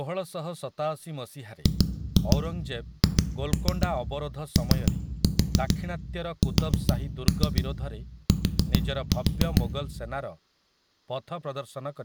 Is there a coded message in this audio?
Yes: tap code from 1.7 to 9.6 s, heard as knocks on a wall, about 7 knocks a second, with room echo and speech in Odia. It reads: GHOST